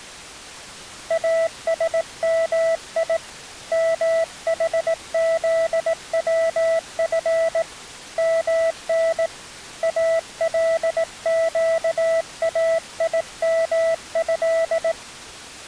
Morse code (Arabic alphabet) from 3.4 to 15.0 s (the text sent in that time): محذوف من القايمه